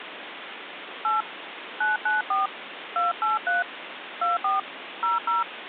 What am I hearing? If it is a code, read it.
DTMF, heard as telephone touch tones, dialled by hand, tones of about 160 ms, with phone line noise. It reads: 8 994 283 24 00